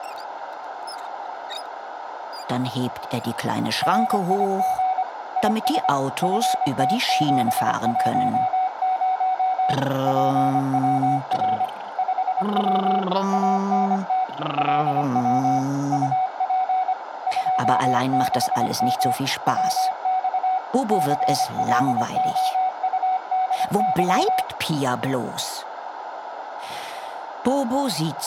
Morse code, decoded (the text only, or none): RIG IS FT710 PWR 5W ANT LW UP 26M WX CLOUDY